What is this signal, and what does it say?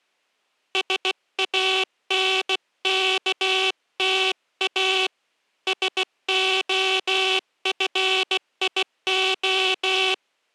Morse code, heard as a buzzer, hand-sent with a bug key, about 16 wpm. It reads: SANKTA SOFIO